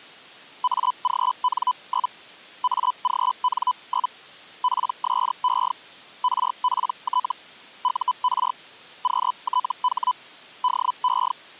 Hellschreiber (Feld-Hell, 122.5 baud), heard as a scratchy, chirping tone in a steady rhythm, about 1000 Hz. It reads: AGN? AGN? PSE RPT UR QTH DE